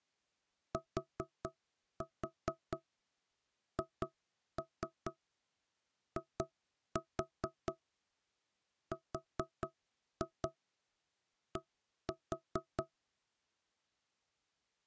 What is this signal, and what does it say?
Tap code, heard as knocks on wood, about 4 knocks a second. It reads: THIRD